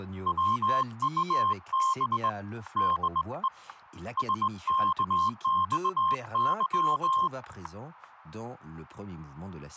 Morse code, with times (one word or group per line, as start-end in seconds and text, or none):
0.3-2.3 WUB
2.8-3.5 DE
4.2-7.3 SKXY